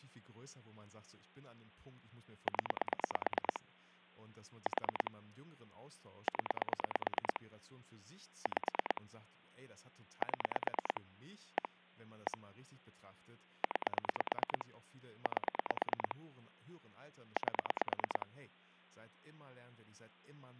Pulse dialling, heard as clicks on a phone line, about 9 pulses a second, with hum and speech in German. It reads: 0 4 0 5 7 1 1 9 8 8